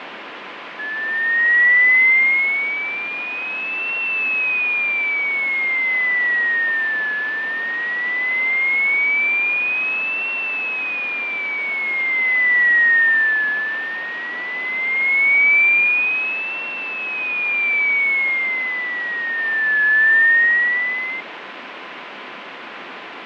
A tone that sweeps in pitch again and again, with radio static and fading. There is no code.